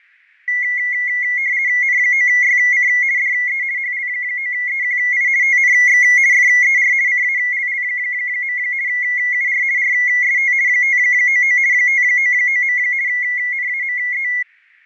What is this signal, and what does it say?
RTTY (50 baud, 170 Hz shift), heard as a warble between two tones, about 2050 Hz centre, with fading. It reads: N9YC DE HL9EQI TNX FER CALL. UR RST 599 599. NAME